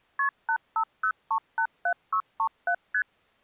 Multi-frequency trunk signalling (R1, as on North American trunks), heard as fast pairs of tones, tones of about 80 ms. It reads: KP 850387637 ST